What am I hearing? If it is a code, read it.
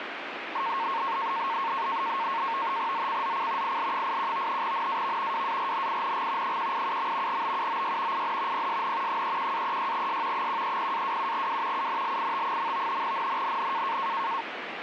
NAVTEX (SITOR-B), 100 baud, 170 Hz shift, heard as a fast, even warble, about 1000 Hz centre, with radio static. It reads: ZCZC IL81 NAV WARNING 187. BUOY IN PSN 31-36S 130-27W UNLIT. NNNN